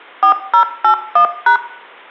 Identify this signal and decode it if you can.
DTMF, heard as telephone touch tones, dialled by machine, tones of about 100 ms, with room echo. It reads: 4081#